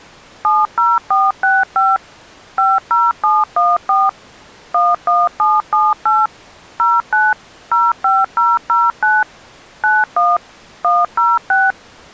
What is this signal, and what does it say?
DTMF, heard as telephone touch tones, dialled by machine, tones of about 200 ms. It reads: 70465 50714 11778 09 05009 91 106